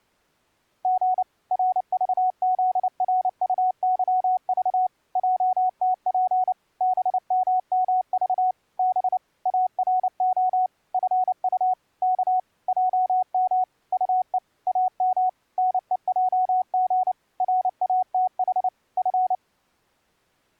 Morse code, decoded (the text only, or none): G RVZRUYV JTP BMMV B ARO FU K JM UE AM NEJG RATH F